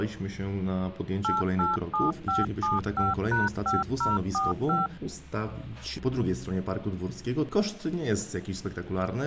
DTMF, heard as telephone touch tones, dialled by machine, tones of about 170 ms. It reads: 887575#5045